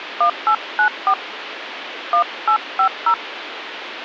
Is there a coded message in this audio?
Yes: DTMF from 0.2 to 3.1 s, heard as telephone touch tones, dialled by hand, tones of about 90 ms, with phone line noise. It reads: 1894 1850